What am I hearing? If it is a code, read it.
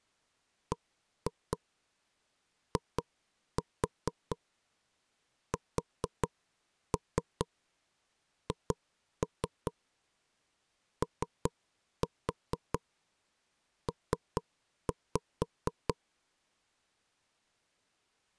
Tap code, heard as knocks on wood, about 4 knocks a second. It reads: BISHOP